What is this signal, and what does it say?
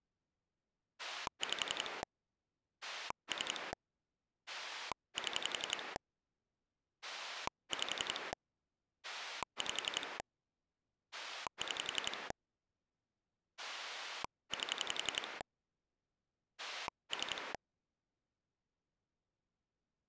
Pulse dialling, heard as a rotary dial, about 11 pulses a second. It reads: 5 3 7 5 5 6 8 3